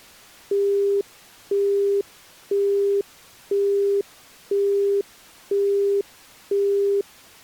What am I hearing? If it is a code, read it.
Telephone call progress tone (single-tone plan, as in Europe, Japan and elsewhere), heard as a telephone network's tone, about 400 Hz, 0.5 s on and 0.5 s off. Busy tone.